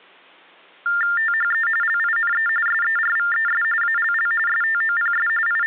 TTY/TDD text telephone tones (45.45 baud Baudot), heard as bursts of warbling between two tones, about 400 Hz shift, 1600 Hz centre. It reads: THE LINE SERVES ALL STOPS …